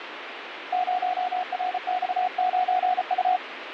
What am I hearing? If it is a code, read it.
Morse code, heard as a keyed tone, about 34 wpm, 730 Hz, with radio static. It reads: 0RX9U